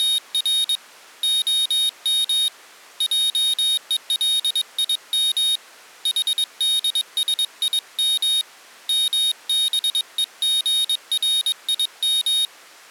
Morse code (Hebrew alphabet), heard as a high beeper, hand-sent with a paddle, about 22 wpm, 3750 Hz. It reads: … הם עולים חדשים מבוגרים